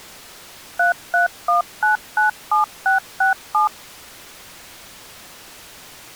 DTMF, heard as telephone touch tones, dialled by machine, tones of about 130 ms. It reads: 331997667